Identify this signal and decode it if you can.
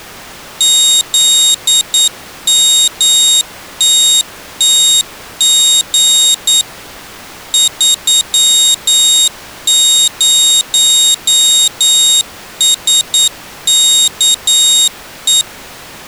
Morse code, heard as a high beeper, machine-sent, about 9 wpm, 3750 Hz. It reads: ZMTTG 30SKE